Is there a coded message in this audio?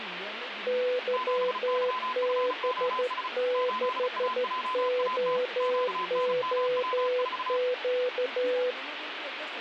Yes: Morse code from 0.6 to 8.8 s, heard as two keyed tones, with radio static and speech in Hindi. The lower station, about 13 wpm, 500 Hz: YB6OOQ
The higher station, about 35 wpm, 1020 Hz: 7YFOS 8AJAT QNMW4